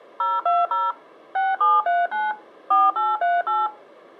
DTMF, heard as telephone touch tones, dialled by machine, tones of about 200 ms. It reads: 020 6739 4838